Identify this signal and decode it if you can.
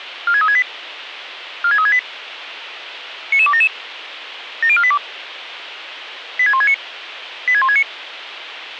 Five-tone selective call (ZVEI), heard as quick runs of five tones, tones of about 70 ms, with radio hiss. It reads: 46368 46368 99277 70482 86169 86169